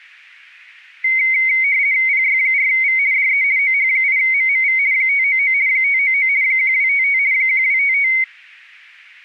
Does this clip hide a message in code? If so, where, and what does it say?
Yes: RTTY (50 baud, 170 Hz shift) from 1.0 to 8.2 s, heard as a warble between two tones, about 2150 Hz centre. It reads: PY4V DE OH8MMV 599 599 1255 1255